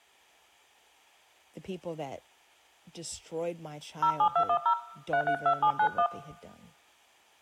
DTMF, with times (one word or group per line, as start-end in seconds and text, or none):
4.0-4.7 07210
5.1-6.1 332791